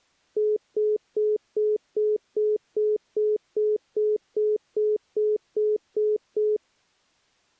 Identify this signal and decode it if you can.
Telephone call progress tone (single-tone plan, as in most of Europe), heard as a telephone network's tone, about 420 Hz, 0.2 s on and 0.2 s off. Congestion tone.